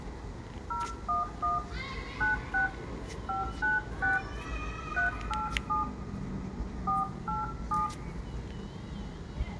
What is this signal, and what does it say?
DTMF, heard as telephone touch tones, dialled by hand, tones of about 160 ms, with room echo and the noise of a residential street. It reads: 011 96 596 387 487